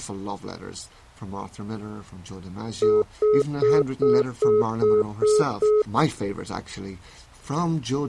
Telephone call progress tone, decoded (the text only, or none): congestion tone